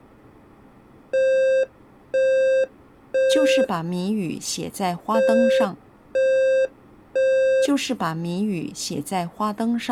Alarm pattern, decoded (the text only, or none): temporal three